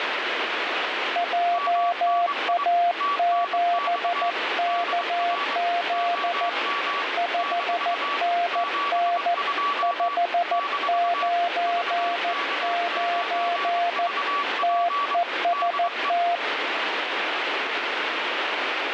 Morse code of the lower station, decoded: JA7KZ 5NN 599 TEST

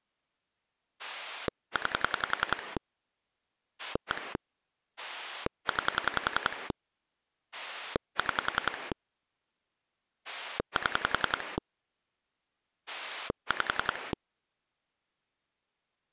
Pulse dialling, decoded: 9 1 9 6 7 5

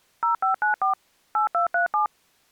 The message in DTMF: 0594 8237

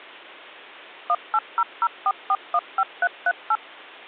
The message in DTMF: 18004415338

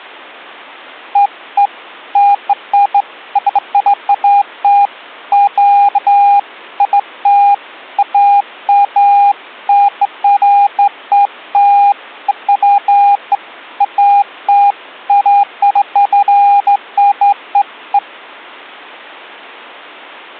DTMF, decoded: none

